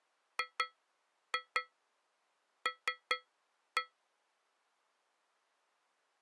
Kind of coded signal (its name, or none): tap code